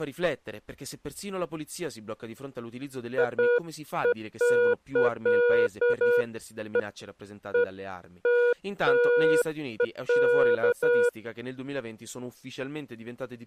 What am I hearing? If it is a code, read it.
Beeps of irregular length, with speech in Italian. There is no code.